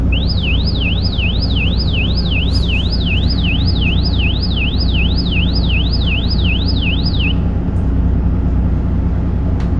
A tone that sweeps in pitch again and again, with the noise inside a bus. There is no code.